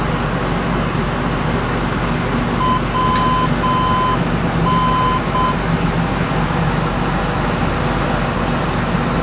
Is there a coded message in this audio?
Yes: Morse code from 2.5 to 5.6 s, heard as a keyed tone, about 7 wpm, 1020 Hz, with kitchen noise. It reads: WN